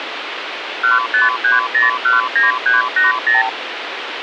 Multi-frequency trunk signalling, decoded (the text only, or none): 153019380